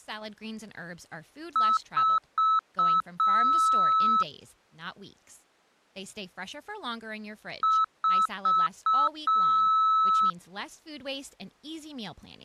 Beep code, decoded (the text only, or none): 4 short, 1 long